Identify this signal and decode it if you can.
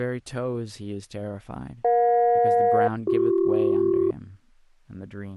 Aircraft SELCAL, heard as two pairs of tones, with speech in English. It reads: EJ-BC